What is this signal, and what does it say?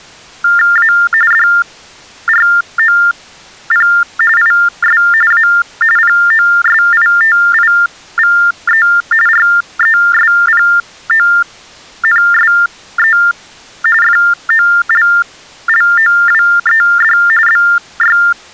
TTY/TDD text telephone tones (45.45 baud Baudot), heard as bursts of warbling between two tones, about 400 Hz shift, 1600 Hz centre. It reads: A DROP IS A POSITIVE RESPONSE FOLLOWED BY